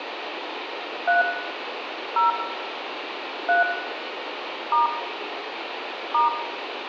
DTMF, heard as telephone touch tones, dialled by hand, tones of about 140 ms, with phone line noise and room echo. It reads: 3 0 3 * *